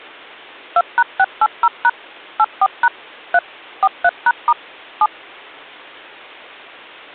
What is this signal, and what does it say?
DTMF, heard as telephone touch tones, dialled by machine, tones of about 50 ms. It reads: 2#680# 84# 3 43#* 7